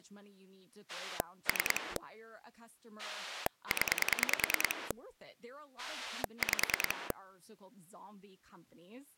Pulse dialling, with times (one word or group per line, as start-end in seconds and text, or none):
0.9-2.0 3
3.0-4.9 0
5.8-7.1 5